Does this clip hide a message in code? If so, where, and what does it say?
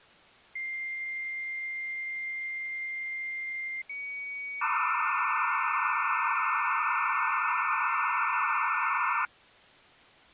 Yes: dial-up modem handshake (low-speed, two carriers) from 0.6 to 9.3 s, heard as two whistles, then hiss.